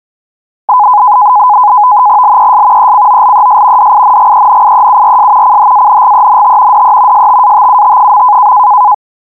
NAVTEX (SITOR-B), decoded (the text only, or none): LES ECOLES DINGENIEURS CHANGENT DE STATUT.